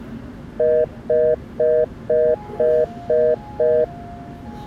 Telephone call progress tone (North American plan), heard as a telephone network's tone, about 480, 620 Hz, 0.25 s on and 0.25 s off, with the noise inside a subway train. Congestion tone.